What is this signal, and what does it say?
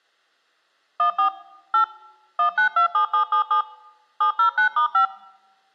DTMF, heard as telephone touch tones, dialled by machine, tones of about 100 ms. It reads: 14 8 1927777 709*5